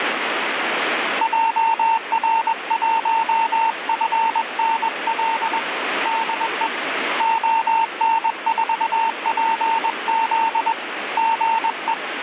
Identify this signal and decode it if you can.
Morse code, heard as a keyed tone, hand-sent with a paddle, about 21 wpm, 900 Hz, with radio static. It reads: JR1FNL DE ON4PZ GE